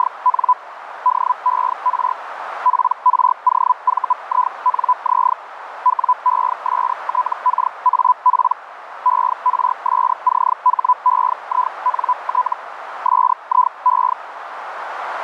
Hellschreiber (Feld-Hell, 122.5 baud), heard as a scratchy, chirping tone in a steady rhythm, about 1000 Hz, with radio static and a narrow filter. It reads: … DER PROVINZ WESTKAP ERSCHEINT SIE